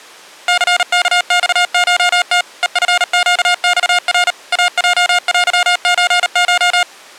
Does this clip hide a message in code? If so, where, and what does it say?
Yes: Morse code (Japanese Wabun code) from 0.4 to 6.9 s, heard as electronic beeps, machine-sent, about 38 wpm, 710 Hz. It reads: ニワマコム ヘチネマナ イヲテソコ